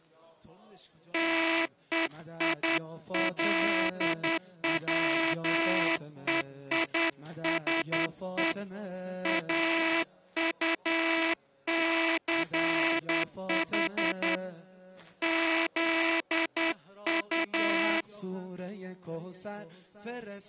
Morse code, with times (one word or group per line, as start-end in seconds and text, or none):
1.1-8.5 TEILWEISE
9.3-14.4 AUCH
15.2-18.0 ZU